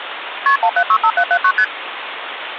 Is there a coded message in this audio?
Yes: multi-frequency trunk signalling (R1, as on North American trunks) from 0.5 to 1.6 s, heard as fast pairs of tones, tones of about 70 ms, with phone line noise. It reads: KP 1765779 ST